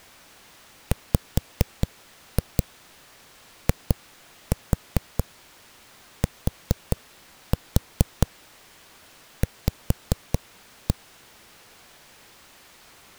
Tap code, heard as knocks on a wall, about 4 knocks a second. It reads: WITV